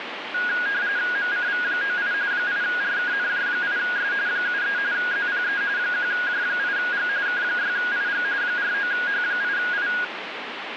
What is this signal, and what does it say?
RTTY (45.45 baud, 170 Hz shift), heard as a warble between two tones, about 1550 Hz centre, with radio static. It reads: MCV98 8RKNJ8S 73 ZPE 1J8G K6IG 49H8I